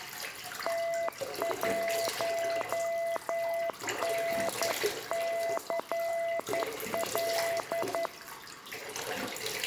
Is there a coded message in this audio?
Yes: Morse code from 0.6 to 8.1 s, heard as a keyed tone, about 11 wpm, 670 Hz, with room echo and the noise of a restroom. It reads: T1NCL